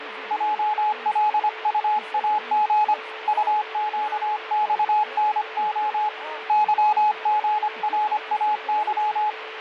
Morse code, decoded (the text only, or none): JLUAG UQXNO YGRAY